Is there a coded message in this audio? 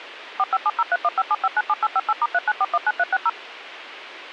Yes: DTMF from 0.4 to 3.3 s, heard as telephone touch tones, dialled by machine, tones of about 40 ms, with radio hiss. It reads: 45703157597858*39419360